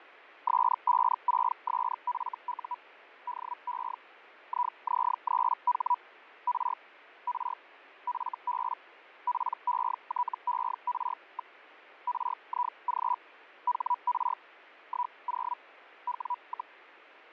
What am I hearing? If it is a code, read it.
Hellschreiber (Feld-Hell, 122.5 baud), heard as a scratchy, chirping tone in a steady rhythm, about 980 Hz, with radio static and fading. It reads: S56SFU DE IZ3H R R FB PETER. RIG HR 10 W,